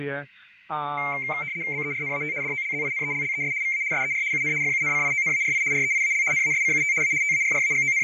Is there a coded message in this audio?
Yes: RTTY (75 baud, 170 Hz shift) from 1.0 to 8.0 s, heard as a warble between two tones, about 2200 Hz centre, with radio static and fading. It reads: BERNAT DOLZINELLES VA SER UN FUNCIONARI REIAL NASCUT A …